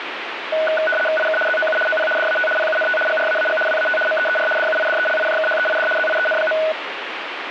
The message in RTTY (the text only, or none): IK ZOU OP DAT PUNT GRAAG WAT MEER DUIDELIJKHEID ZIEN.